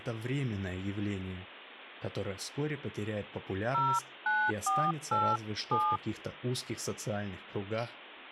DTMF, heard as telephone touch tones, dialled by hand, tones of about 250 ms, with speech in Russian. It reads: 09487